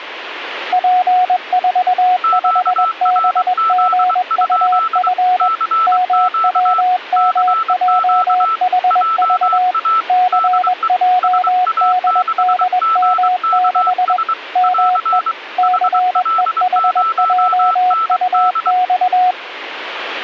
Morse code, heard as two keyed tones, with radio static. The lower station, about 21 wpm, 730 Hz: P45BGUF MWMJHV CJDDM6 ME CEHJUX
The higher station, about 23 wpm, 1320 Hz: QRZ? CQ CQ JA DE SA6GKS <AR> HL0ND